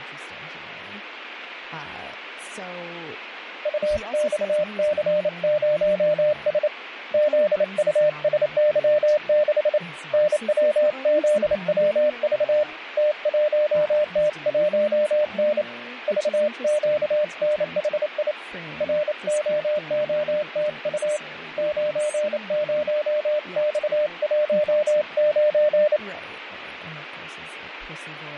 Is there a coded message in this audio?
Yes: Morse code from 3.6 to 26.0 s, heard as a keyed tone, hand-sent with a paddle, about 28 wpm, 600 Hz, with radio static and speech in English. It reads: UXC0S ZUSY6 NWZWV T1T1N VQNHI ROOTU 90X19